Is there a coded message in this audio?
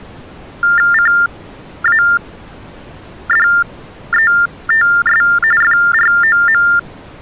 Yes: TTY/TDD text telephone tones (45.45 baud Baudot) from 0.6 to 6.8 s, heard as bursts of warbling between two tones, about 400 Hz shift, 1600 Hz centre. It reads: CADETS FROM